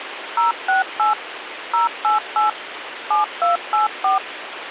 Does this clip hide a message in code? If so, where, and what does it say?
Yes: DTMF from 0.4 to 4.2 s, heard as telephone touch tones, dialled by machine, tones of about 140 ms, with phone line noise. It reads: 068 088 7284